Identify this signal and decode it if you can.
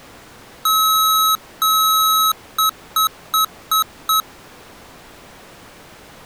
Beep code, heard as beeps from a small speaker, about 1290 Hz. 2 long, 5 short.